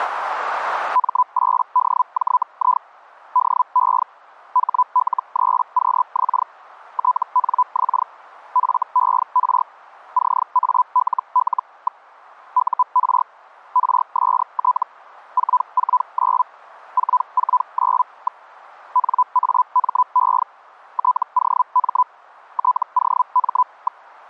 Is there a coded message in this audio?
Yes: Hellschreiber (Feld-Hell, 122.5 baud) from 0.9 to 24.0 s, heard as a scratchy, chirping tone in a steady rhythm, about 1000 Hz. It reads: M8DJI DE HL3QX TNX FER CALL. UR RST 449 449. NAME TOM TOM.